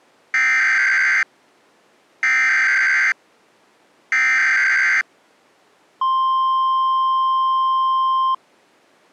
Emergency Alert System (SAME) tones (header bursts, then the 1050 Hz attention tone), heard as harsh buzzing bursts, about 520.83 baud.